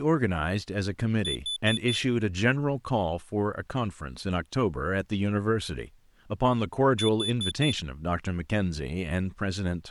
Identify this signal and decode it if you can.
Alarm pattern, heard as an alarm's beeps, played twice, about 3500 Hz, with speech in English. Temporal four. Carbon monoxide.